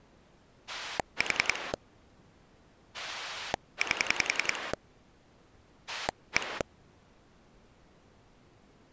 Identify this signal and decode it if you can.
Pulse dialling, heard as a rotary dial, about 10 pulses a second. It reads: 4 8 1